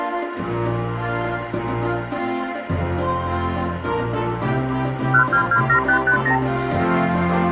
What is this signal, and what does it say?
Multi-frequency trunk signalling (R2, with the far end's replies), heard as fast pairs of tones, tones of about 90 ms, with phone line noise. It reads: 1227550